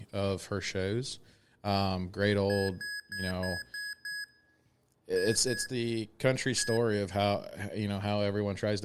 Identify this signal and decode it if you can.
Beep code, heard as beeps from a small speaker, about 1650 Hz, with speech in English. 6-2-1.